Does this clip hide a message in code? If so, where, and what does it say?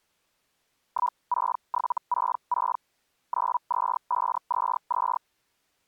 Yes: Hellschreiber (Feld-Hell, 122.5 baud) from 0.9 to 5.2 s, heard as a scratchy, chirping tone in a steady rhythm, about 980 Hz. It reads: 16766 92522